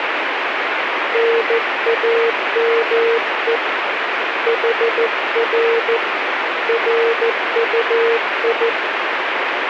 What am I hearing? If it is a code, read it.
Morse code, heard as a keyed tone, hand-sent with a paddle, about 14 wpm, 460 Hz, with radio static. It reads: NAME HR RUI